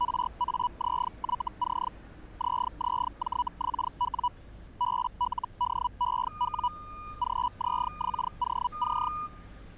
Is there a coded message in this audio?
Yes: Hellschreiber (Feld-Hell, 122.5 baud) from 0.0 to 9.1 s, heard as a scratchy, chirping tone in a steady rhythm, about 980 Hz, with street noise. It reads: RAZYC ZZJXW BLDEW GZXOC